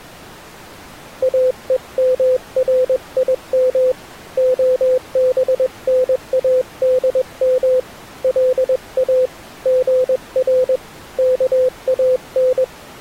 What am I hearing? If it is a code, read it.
Morse code (Hebrew alphabet), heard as a keyed tone, hand-sent with a paddle, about 21 wpm, 510 Hz. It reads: אומרים הבןאדם לא גר כאן